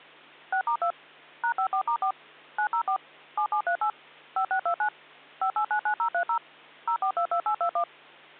DTMF, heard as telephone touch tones, dialled by machine, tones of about 90 ms, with hum. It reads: 6*2 #54*4 904 7738 5629 5899030 0422821